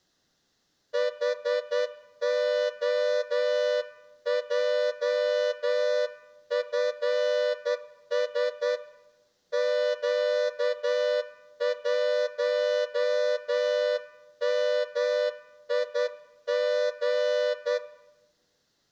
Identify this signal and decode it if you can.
Morse code, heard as a horn, hand-sent with a straight key, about 10 wpm. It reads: HOJFS Q1MIG